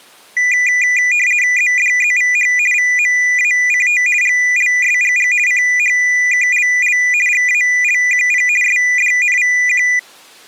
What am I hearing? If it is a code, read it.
RTTY (50 baud, 450 Hz shift), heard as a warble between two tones, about 2200 Hz centre. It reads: ZDZVH VMACT GLSGG CHKLL GALQP SDNVQ